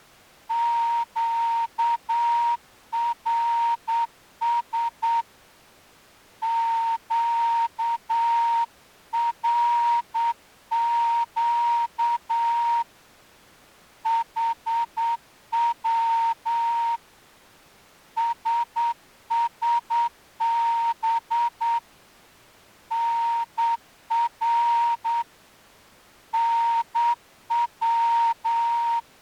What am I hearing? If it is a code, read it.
Morse code, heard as a whistle, hand-sent with a straight key, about 8 wpm. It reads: QRS QRQ HW SSB NR NW